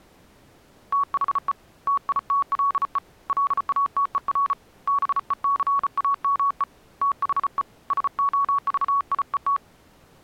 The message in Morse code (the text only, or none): THE TITLE LATER BECAME THE SOVIET